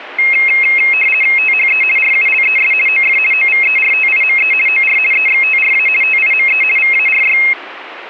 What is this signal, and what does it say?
RTTY (50 baud, 450 Hz shift), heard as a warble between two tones, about 2350 Hz centre. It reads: THE RULES OF OVERTIME OR EXTRA TIME VARY